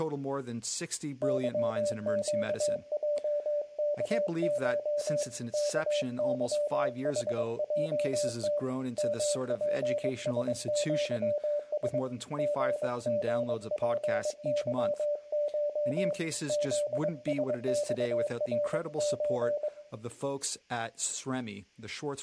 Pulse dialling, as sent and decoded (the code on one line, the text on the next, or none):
none